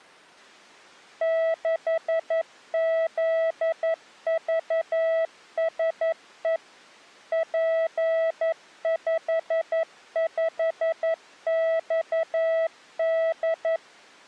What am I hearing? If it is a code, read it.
Morse code, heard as a keyed tone, machine-sent, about 11 wpm, 650 Hz. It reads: 6ZVSE P55XD